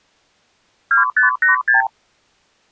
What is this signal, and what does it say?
Multi-frequency trunk signalling (R2, with the far end's replies), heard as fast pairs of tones, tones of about 130 ms. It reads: 2586